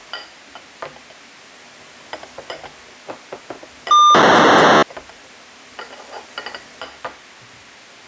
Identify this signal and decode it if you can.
POCSAG pager data (2400 baud), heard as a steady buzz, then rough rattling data, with kitchen noise.